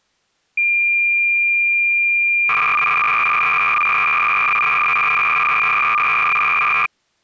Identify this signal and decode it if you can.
Cassette data (Kansas City type), 300 baud, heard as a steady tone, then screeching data.